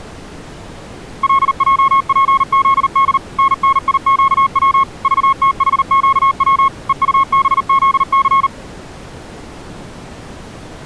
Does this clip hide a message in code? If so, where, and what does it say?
Yes: Morse code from 1.2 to 8.5 s, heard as a keyed tone, machine-sent, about 39 wpm, 1090 Hz. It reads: LJPZD NNIQW VTHQW EUBZC